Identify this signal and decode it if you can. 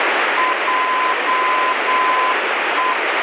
Morse code, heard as a keyed tone, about 8 wpm, 1020 Hz, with heavy radio static. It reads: JE